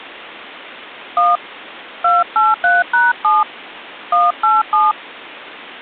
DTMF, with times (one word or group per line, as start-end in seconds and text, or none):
1.2-1.4 1
2.0-3.4 283#7
4.1-4.9 187